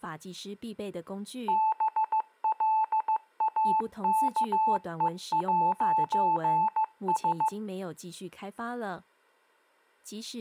Morse code, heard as a keyed tone, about 15 wpm, 870 Hz, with speech in Chinese. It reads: BLAKE'S